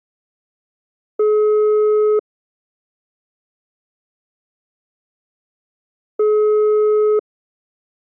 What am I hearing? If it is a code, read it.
Telephone call progress tone (single-tone plan, as in most of Europe), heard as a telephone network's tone, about 420 Hz, 1 s on and 4 s off. Ringback tone.